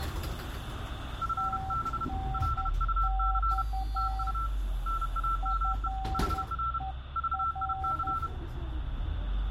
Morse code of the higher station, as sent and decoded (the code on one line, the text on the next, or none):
..-. -... / .-.. ..- -.-. / - ..- / -. .- -- . / .... .-. / ...- .. -.-.
FB LUC TU NAME HR VIC